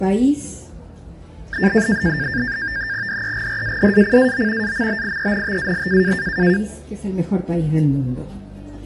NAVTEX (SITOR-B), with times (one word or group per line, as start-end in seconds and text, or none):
3.1-4.7 DEGRADACAO
4.6-6.1 AMBIENTAL